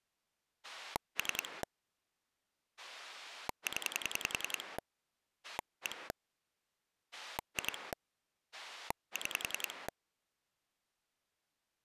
Pulse dialling, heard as a rotary dial, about 10 pulses a second. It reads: 3 0 1 2 6